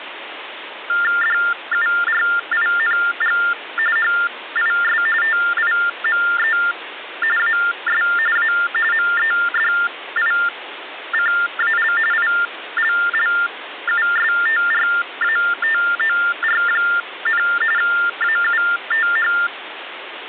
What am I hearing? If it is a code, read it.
TTY/TDD text telephone tones (45.45 baud Baudot), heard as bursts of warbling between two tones, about 400 Hz shift, 1600 Hz centre, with phone line noise. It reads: DURING HIS TIME AS A MEDICAL ILLUSTRATOR, AUTH